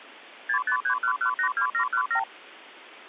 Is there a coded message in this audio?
Yes: multi-frequency trunk signalling (R2, with the far end's replies) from 0.5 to 2.2 s, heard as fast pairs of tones, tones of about 90 ms. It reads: 6531182717